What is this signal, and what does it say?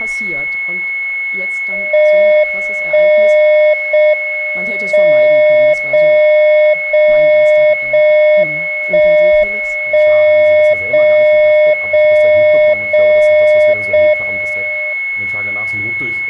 Radio time signal (JJY), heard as a tone whose level steps once a second, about 610 Hz, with a steady whistle near 2190 Hz. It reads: 1 0 M 0 0 0 1 1 0 0 0 0 M